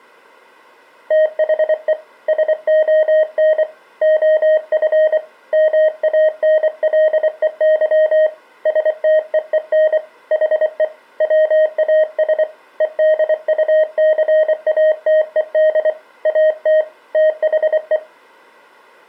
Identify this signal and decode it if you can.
Morse code, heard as a keyed tone, hand-sent with a paddle, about 24 wpm, 620 Hz. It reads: THE SON OF MANLEY STEEN HE WAS EDUCATED AT THE